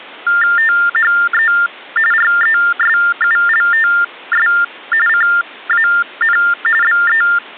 TTY/TDD text telephone tones (45.45 baud Baudot), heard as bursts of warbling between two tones, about 400 Hz shift, 1600 Hz centre. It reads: THE RESULTS CAN BE